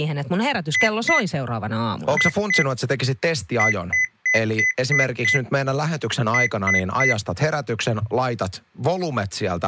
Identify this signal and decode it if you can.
Beep code, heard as beeps from a small speaker, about 2000 Hz, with speech in Finnish. 2-2-6-3.